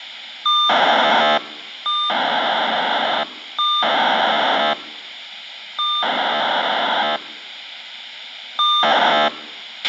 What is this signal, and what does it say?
POCSAG pager data (2400 baud), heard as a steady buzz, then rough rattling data, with radio hiss and a squelch burst at the end.